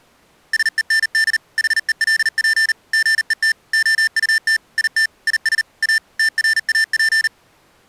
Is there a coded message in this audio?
Yes: Morse code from 0.5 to 7.3 s, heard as electronic beeps, machine-sent, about 39 wpm, 1800 Hz. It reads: SEND HELP GET OUT IT IS A TRAP